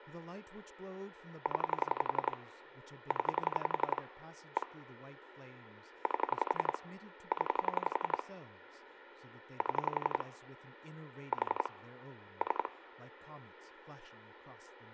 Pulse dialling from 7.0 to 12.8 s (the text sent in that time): 0 7 4 3